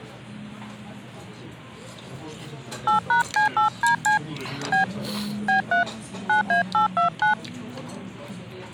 DTMF, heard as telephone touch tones, dialled by hand, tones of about 120 ms, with the noise of a restaurant. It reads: 8#C8DC B B3 9A829